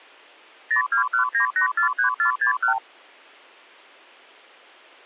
Multi-frequency trunk signalling (R2, with the far end's replies), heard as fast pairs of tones, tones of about 110 ms. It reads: 0219843461